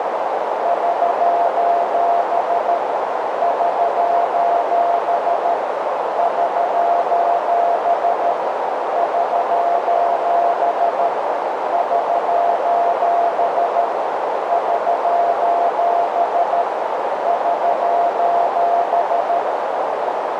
Morse code, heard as a keyed tone, machine-sent, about 13 wpm, 690 Hz, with heavy radio static and a narrow filter. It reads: <SOS> <SOS> <SOS> <SOS> <SOS> <SOS> <SOS>